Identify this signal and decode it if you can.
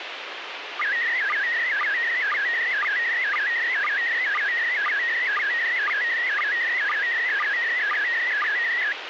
SSTV (slow-scan television), PD 120, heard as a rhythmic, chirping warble, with radio hiss.